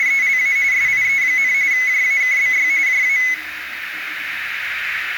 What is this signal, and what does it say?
RTTY (45.45 baud, 170 Hz shift), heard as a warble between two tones, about 2100 Hz centre, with radio static, a narrow filter and the noise of a restroom. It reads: … SIE, JAKBY JA